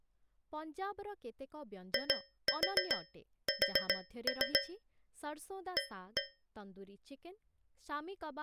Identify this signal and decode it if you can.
Tap code, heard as taps on a metal pipe, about 7 knocks a second, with speech in Odia. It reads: IS A